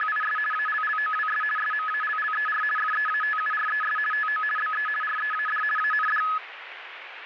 RTTY (50 baud, 450 Hz shift), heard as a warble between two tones, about 1490 Hz centre, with radio static. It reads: … ALLOWS SMALLER FEATURES TO BE READ AND